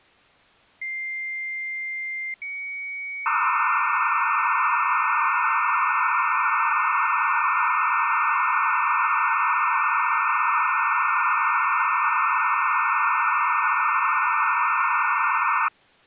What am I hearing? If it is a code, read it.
Dial-up modem handshake (low-speed, two carriers), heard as two whistles, then hiss.